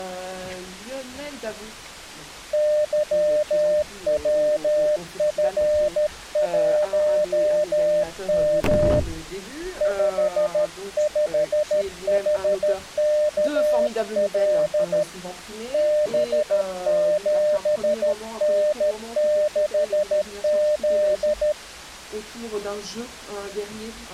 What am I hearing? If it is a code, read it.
Morse code, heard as a keyed tone, hand-sent with a paddle, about 13 wpm, 600 Hz. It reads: YWF1M 55HKL B7N6Z